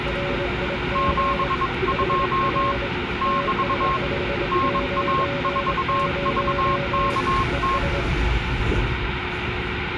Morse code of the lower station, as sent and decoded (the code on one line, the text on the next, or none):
.-. .. --. / .... .-. / - ... ..... ----. ----- / . ...
RIG HR TS590 ES